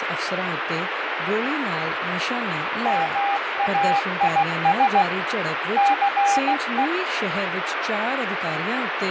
Morse code, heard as a keyed tone, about 16 wpm, 800 Hz, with radio static and fading. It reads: MAIS CE